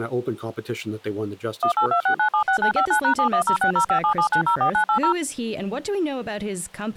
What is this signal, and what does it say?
DTMF, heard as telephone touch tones, dialled by machine, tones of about 90 ms, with speech in English. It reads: 1826976959#71060577904980